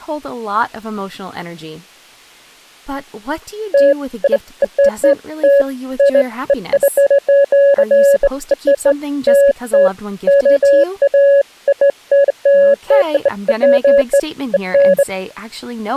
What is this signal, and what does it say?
Beeps of irregular length, with speech in English. There is no code.